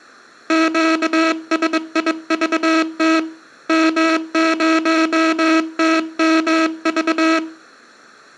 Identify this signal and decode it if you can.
Morse code, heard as a buzzer, hand-sent with a bug key, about 22 wpm. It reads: QSIVT M0TMV